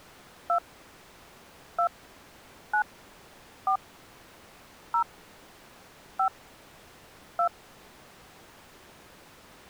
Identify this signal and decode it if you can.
DTMF, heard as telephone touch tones, dialled by hand, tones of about 90 ms. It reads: 2 2 9 4 0 5 2